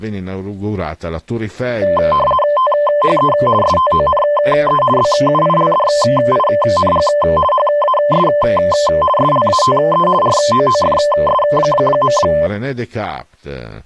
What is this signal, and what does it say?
RTTY (50 baud, 450 Hz shift), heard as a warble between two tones, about 810 Hz centre, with speech in Italian. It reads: THE STONE BUILDING HAS SLATE ROOFS.